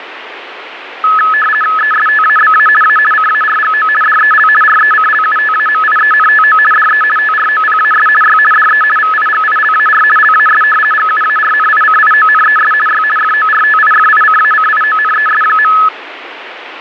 RTTY (50 baud, 450 Hz shift), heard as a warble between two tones, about 1500 Hz centre, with radio static. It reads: ESTABA A CARGO DEL RECLUTAMIENTO DE TROPAS Y DE VIGILAR LAS GUARNICIONES Y FORTIFICACIONES.